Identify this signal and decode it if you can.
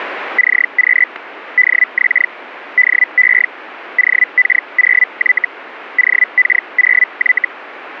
Hellschreiber (Feld-Hell, 122.5 baud), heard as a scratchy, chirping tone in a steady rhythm, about 2000 Hz. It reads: CQ DX DE OK0Y OK0Y